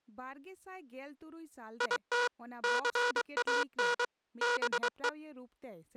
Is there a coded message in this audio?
Yes: Morse code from 1.7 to 5.2 s, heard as a buzzer, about 23 wpm, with speech in Santali. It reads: IT CAN BE